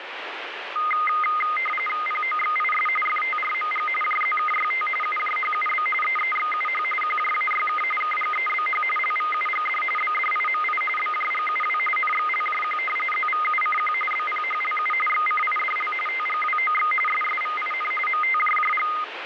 RTTY (45.45 baud, 850 Hz shift), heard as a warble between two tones, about 1650 Hz centre, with radio static. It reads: POXIS FTRMG JZKYT UJHUB EEXUH QJAYK KGEBH LVUGD BDIMI BJGUW NXLJQ ZVUCQ BPHLU XCIDL TGWOX SSVIN MTJJG